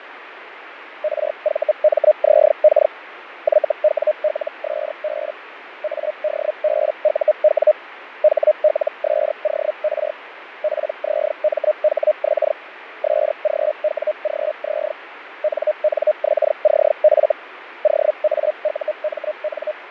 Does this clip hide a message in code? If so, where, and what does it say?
Yes: Hellschreiber (Feld-Hell, 122.5 baud) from 1.0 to 19.7 s, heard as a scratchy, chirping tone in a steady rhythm, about 610 Hz, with radio static and fading. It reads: RVMZK YWLSB ADBUW HLSOR PZMHX SGWGZ NNXCF OAUMN